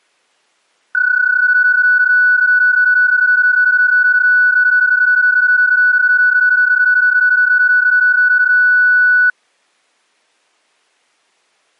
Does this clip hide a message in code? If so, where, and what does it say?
Yes: PSK31 (31.25 baud) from 0.9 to 9.3 s, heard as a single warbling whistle, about 1480 Hz.